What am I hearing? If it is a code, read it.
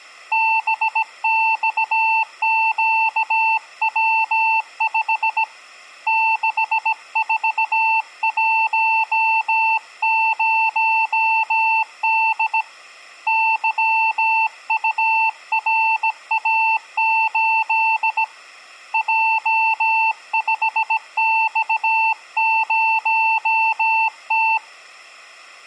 Morse code, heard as a keyed tone, hand-sent with a bug key, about 17 wpm, 890 Hz. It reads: BXQW5 6410D YURA8 J5X0T